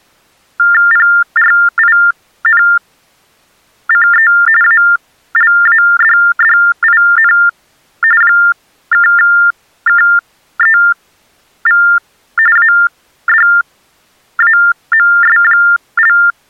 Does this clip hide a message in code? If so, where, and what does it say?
Yes: TTY/TDD text telephone tones (45.45 baud Baudot) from 0.6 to 16.3 s, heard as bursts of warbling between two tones, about 400 Hz shift, 1600 Hz centre. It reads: PRINCE ALADDIN (KEV ADAMS)